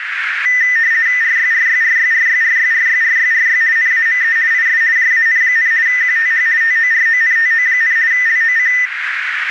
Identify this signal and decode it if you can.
RTTY (50 baud, 170 Hz shift), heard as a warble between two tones, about 1900 Hz centre, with radio static and a narrow filter. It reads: RYRYRYRYRYRYRYRY NAME IS JAN, QTH TORONTO, LOC